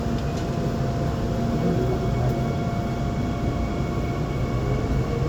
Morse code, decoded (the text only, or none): none